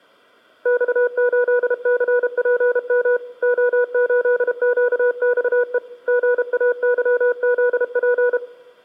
Morse code, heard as a keyed tone, hand-sent with a paddle, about 32 wpm, 490 Hz, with room echo. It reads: X8CPM O8QXE GAYZP